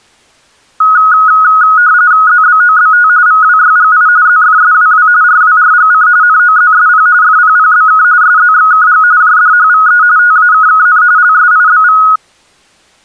RTTY (45.45 baud, 170 Hz shift), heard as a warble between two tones, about 1360 Hz centre. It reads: ZBOBT VWYGI ZFSWW RWRGC NOZSP FPPBK SZXKG JDHVE TAKKN LSIBV